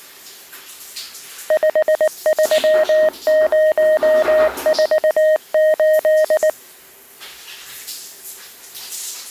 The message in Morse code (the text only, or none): 53048